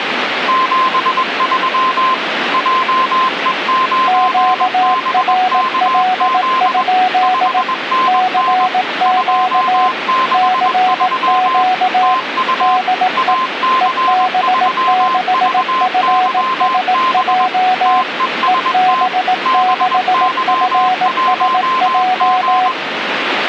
Morse code, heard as two keyed tones, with radio static. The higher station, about 21 wpm, 1040 Hz: 73 JE9BKZ 5NN 263 TU AC3VYB TEST BY1G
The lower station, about 18 wpm, 740 Hz: QRL? CQ CQ DE EB6FSJ EB6FSJ